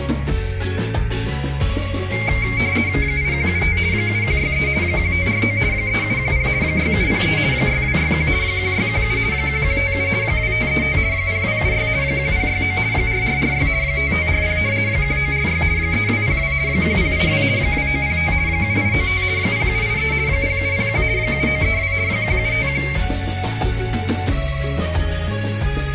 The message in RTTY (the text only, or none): 8175 7163 1549 3710 6703 6261 1617 1157 2535 0276 1069 4446 5540 1946 3202 1082 2905 7895 0783 0701 7932 1751